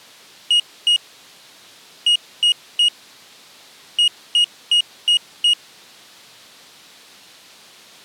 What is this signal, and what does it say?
Beep code, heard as a piezo beeper, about 2900 Hz. 2-3-5.